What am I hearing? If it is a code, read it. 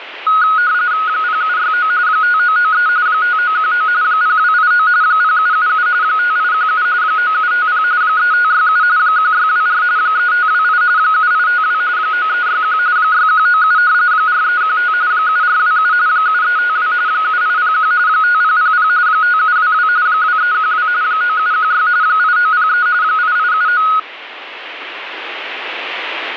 RTTY (45.45 baud, 170 Hz shift), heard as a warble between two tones, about 1360 Hz centre, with radio static. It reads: 0769 5993 5919 0289 0777 5817 9750 3567 1624 3528 7852 9361 6197 4315 7427 7352 7801 5000 5722 2312 9716 8903 8879